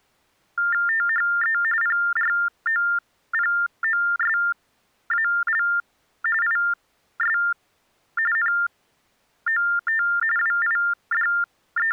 TTY/TDD text telephone tones (45.45 baud Baudot), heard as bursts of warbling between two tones, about 400 Hz shift, 1600 Hz centre. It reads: THE PROPOSAL IS NOT …